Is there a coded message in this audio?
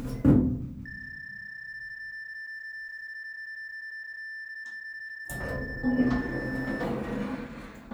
Yes: PSK31 (31.25 baud) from 0.9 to 6.8 s, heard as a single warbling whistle, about 1750 Hz, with the noise inside a lift.